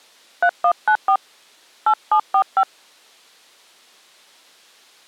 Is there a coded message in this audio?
Yes: DTMF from 0.4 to 2.6 s, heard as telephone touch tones, dialled by hand, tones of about 80 ms. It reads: 3194 8745